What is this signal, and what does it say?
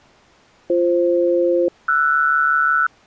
Aircraft SELCAL, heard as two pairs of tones. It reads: BF-RS